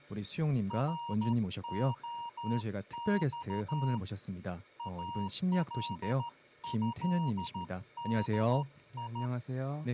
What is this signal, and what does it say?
Morse code (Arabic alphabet), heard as a keyed tone, hand-sent with a straight key, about 13 wpm, 940 Hz, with speech in Korean. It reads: رخص الهدي